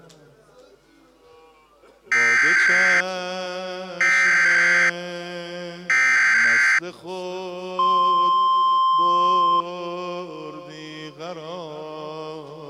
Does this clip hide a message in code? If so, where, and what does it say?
Yes: Emergency Alert System (SAME) tones (header bursts, then the 1050 Hz attention tone) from 2.1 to 9.6 s, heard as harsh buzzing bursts, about 520.83 baud.